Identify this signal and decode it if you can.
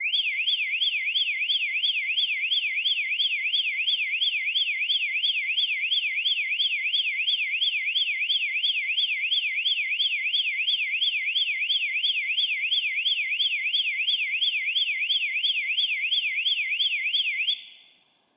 A tone that sweeps in pitch again and again, with room echo. There is no code.